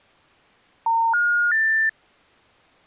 Telephone call progress tone (North American plan), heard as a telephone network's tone, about 910, 1430, 1800 Hz. Special information tone.